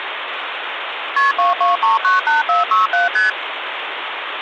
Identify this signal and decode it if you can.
Multi-frequency trunk signalling (R1, as on North American trunks), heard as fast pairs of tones, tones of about 150 ms, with phone line noise. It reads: KP 22398467 ST